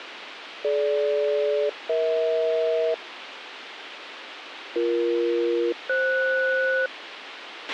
Aircraft SELCAL, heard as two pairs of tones, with radio hiss and a squelch burst at the end. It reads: DG-EH BE-FS